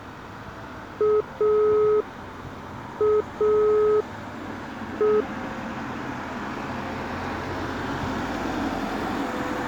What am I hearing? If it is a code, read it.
Telephone call progress tone (pulsed, as in Italy), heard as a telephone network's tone, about 420 Hz, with street noise. Dial tone.